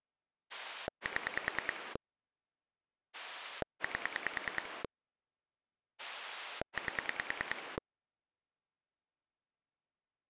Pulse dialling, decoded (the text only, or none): 7 8 8